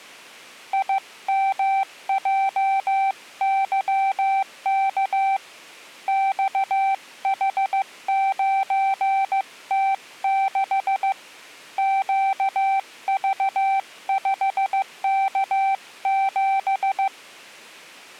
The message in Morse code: IMJYK XH9T6 QV5K7

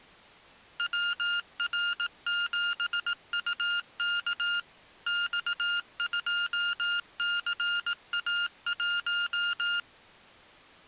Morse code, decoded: WR7UK X2CA1

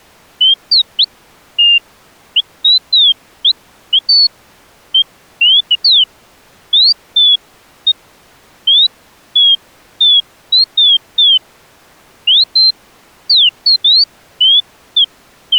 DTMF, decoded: none

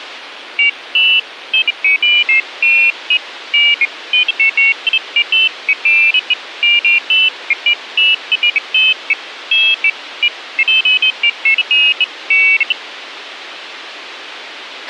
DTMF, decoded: none

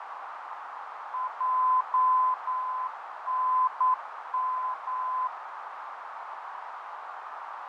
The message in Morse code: JNM

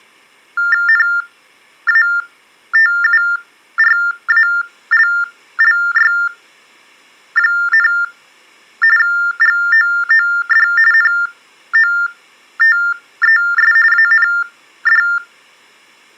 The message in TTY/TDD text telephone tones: NATURALLY, GOOD NOTES AND

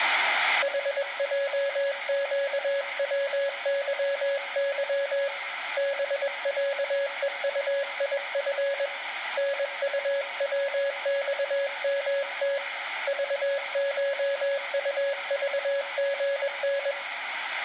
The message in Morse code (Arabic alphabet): حجقوظظ بعءطيف نطوصمت ضشطضغن

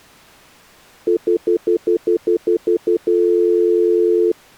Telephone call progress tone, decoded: stutter dial tone

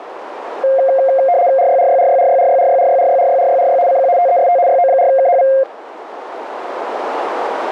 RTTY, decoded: RYRYRYRYRYRYRYRYRYRYRY CQ TEST YO4KHV

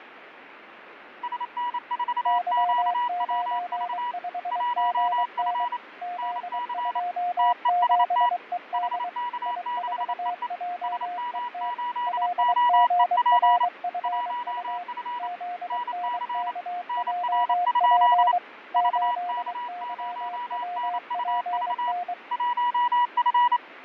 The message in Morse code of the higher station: SN4QWV 1F NC TEST HK6EE SM8OEP 1F NC NR? VK0NUV 1F

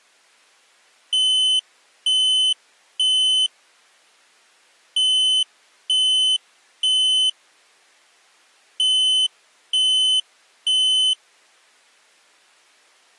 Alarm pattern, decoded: temporal three

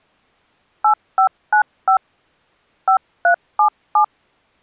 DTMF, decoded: 8595 5377

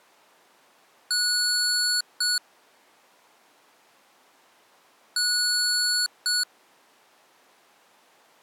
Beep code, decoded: 1 long, 1 short

